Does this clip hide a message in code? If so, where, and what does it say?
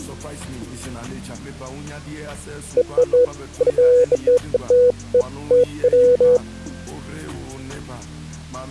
No, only beeps of irregular length.